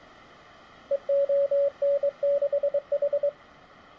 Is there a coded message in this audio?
Yes: Morse code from 0.9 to 3.4 s, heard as a keyed tone, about 23 wpm, 570 Hz. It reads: EON6H